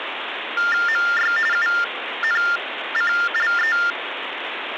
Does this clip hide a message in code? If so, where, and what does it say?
Yes: TTY/TDD text telephone tones (45.45 baud Baudot) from 0.6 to 3.9 s, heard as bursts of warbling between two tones, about 400 Hz shift, 1600 Hz centre, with phone line noise. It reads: MY UNCLE